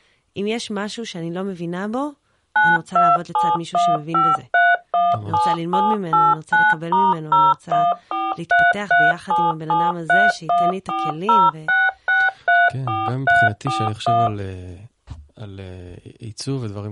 DTMF, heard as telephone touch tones, dialled by machine, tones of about 210 ms, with speech in Hebrew. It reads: 92715317789*014337731406634341